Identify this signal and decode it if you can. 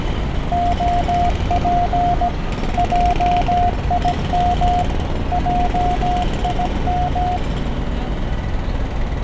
Morse code, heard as a keyed tone, machine-sent, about 17 wpm, 710 Hz, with radio static, a narrow filter and street noise. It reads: OP JIM JIM